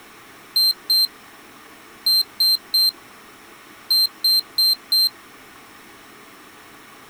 Beep code, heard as a piezo beeper, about 4150 Hz. 2-3-4.